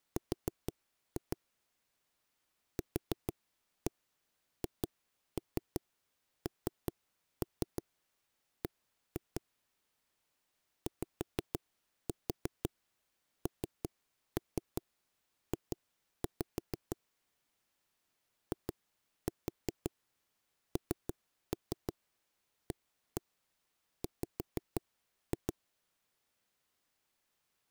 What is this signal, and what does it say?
Tap code, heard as knocks on wood, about 5 knocks a second. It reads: R QHNB YNJ INAW